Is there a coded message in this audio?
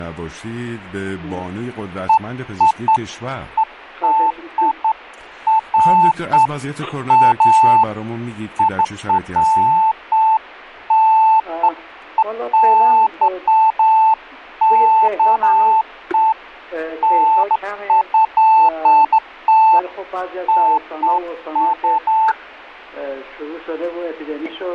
No, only beeps of irregular length.